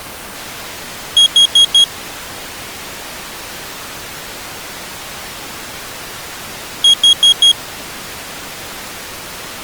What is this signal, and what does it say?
Alarm pattern, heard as an alarm's beeps, played twice, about 3300 Hz. Temporal four. Carbon monoxide.